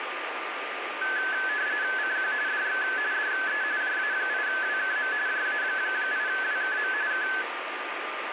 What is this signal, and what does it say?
RTTY (45.45 baud, 170 Hz shift), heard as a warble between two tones, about 1600 Hz centre, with radio static and a steady whistle near 1200 Hz. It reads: CQ DX DE JA8WKM JA8WKM K